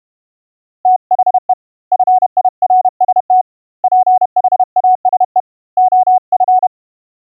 Morse code, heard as a keyed tone, hand-sent with a paddle, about 31 wpm, 740 Hz. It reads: THE FIRST PHASE OF